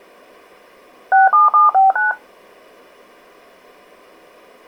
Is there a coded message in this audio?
Yes: DTMF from 1.1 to 2.1 s, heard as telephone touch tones, dialled by machine, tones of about 160 ms. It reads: 67759